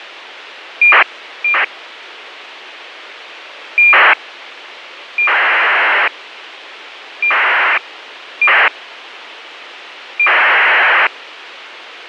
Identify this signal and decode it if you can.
ACARS aircraft data, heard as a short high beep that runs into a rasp, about 2400 baud, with radio hiss.